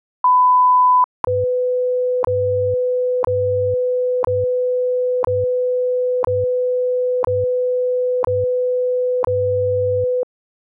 Radio time signal (WWV, Colorado), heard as ticks, one a second.